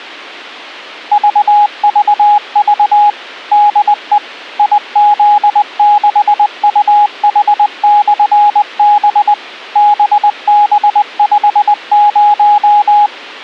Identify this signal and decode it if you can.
Morse code, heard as a keyed tone, machine-sent, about 20 wpm, 830 Hz. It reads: VVV DE IZ6UH/B BB50